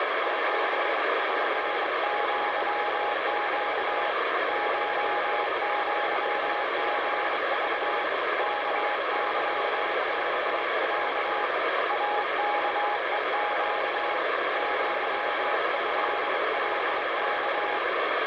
Morse code (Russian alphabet), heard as a keyed tone, hand-sent with a straight key, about 24 wpm, 830 Hz, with heavy radio static. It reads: ЧПЪЩ ШЪГЖ КЫКЯ АКЕЩ ЪЭЛК